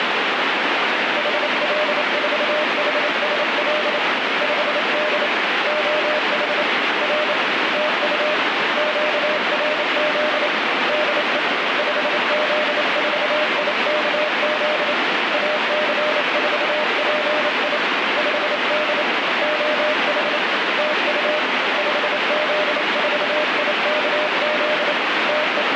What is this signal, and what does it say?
Morse code, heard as a keyed tone, hand-sent with a paddle, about 28 wpm, 610 Hz, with heavy radio static. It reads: HL4HSL 5D OH R TU QRZ DE 5Z4IKZ AC4PI 5D OH TU 5Z4IKZ …